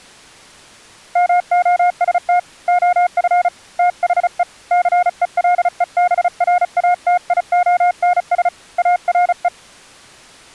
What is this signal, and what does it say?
Morse code, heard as a keyed tone, hand-sent with a paddle, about 35 wpm, 720 Hz. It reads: MOST OF THE CELEBRATIONS ARE